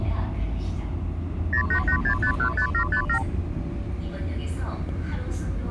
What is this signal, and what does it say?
Multi-frequency trunk signalling (R2, with the far end's replies), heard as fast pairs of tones, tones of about 90 ms, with the noise inside a subway train. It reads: 0886515757